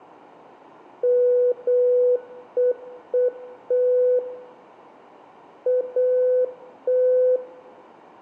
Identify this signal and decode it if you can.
Morse code, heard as a keyed tone, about 8 wpm, 500 Hz, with room echo. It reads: MEET AT